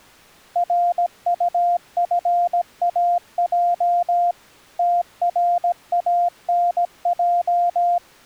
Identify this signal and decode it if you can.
Morse code, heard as a keyed tone, machine-sent, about 17 wpm, 700 Hz. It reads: RUFAJ TRANJ